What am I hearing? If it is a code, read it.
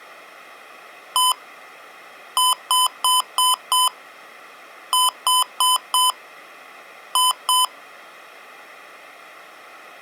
Beep code, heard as beeps from a small speaker, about 1010 Hz. 1-5-4-2.